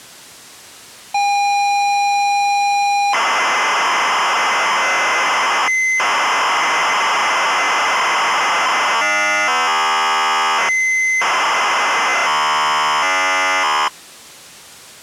ZX Spectrum tape loading, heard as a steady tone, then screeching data.